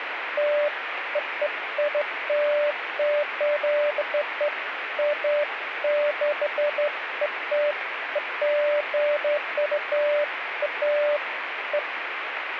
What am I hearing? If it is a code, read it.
Beeps of irregular length, with radio static. There is no code.